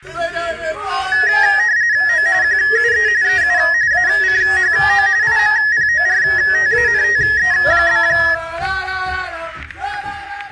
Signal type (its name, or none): RTTY